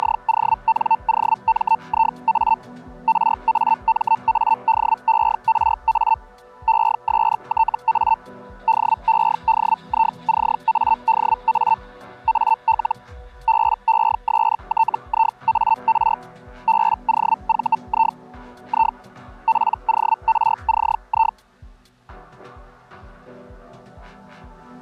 Hellschreiber (Feld-Hell, 122.5 baud), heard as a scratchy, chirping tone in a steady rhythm, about 900 Hz. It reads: … RAMADERA ESTA DEDICADA AL BESTIAR BOVI I PORCI